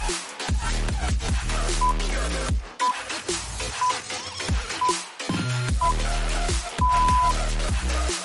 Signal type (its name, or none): radio time signal